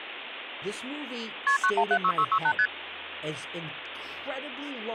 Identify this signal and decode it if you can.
Multi-frequency trunk signalling (R1, as on North American trunks), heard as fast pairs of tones, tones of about 70 ms, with phone line noise and speech in English. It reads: KP 9176668 ST